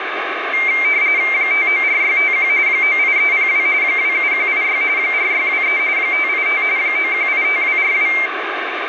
RTTY (45.45 baud, 170 Hz shift), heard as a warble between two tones, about 2200 Hz centre, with radio static. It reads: 594651 98302 27186 4623 585 9185242